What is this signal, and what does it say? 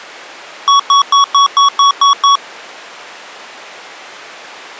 Beep code, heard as beeps from a small speaker, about 1120 Hz. 8 short. In AMI BIOS tables: display memory failure; in Dell tables: LCD failure.